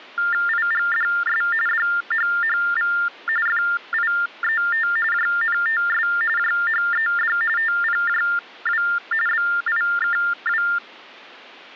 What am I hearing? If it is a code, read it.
TTY/TDD text telephone tones (45.45 baud Baudot), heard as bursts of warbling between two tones, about 400 Hz shift, 1600 Hz centre. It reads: IGDS DHHV FIET JNTS JHED TPJW BIKW